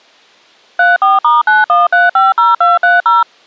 DTMF, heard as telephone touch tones, dialled by machine, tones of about 170 ms. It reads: 34*91350230